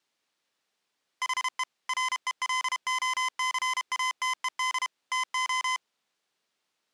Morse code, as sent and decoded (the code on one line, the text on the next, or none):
.... . / .-. . .-.. --- -.-. .- - . -.. / - ---
HE RELOCATED TO